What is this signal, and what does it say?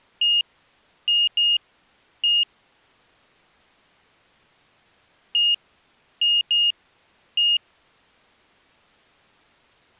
Beep code, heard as a piezo beeper, played twice, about 2850 Hz. 1-2-1. In Phoenix BIOS tables: interval timer failure.